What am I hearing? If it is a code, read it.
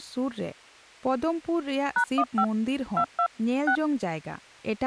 DTMF, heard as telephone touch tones, dialled by hand, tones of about 80 ms, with speech in Santali. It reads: #15 22 6